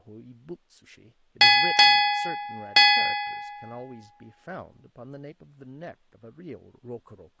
Ship's bell, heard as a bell, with speech in English. 3. Three half-hours of the watch have passed.